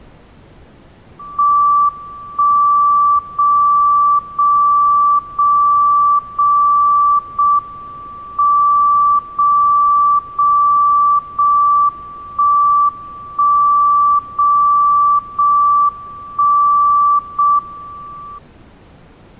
Radio time signal (JJY), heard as a tone whose level steps once a second, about 1160 Hz. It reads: 1 0 0 0 0 0 M 0 0 0 1 1 0 0 1 0 M